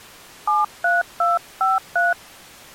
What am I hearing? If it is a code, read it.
DTMF, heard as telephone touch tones, dialled by hand, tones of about 170 ms. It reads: 73253